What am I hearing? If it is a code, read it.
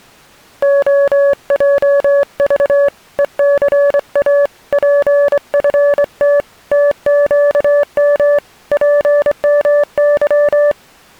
Morse code, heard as a keyed tone, hand-sent with a straight key, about 24 wpm, 570 Hz. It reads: OJV ECA PFT TQM PMY